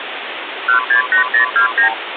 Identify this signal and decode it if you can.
Multi-frequency trunk signalling (R2, with the far end's replies), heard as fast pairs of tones, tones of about 110 ms, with phone line noise. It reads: 168029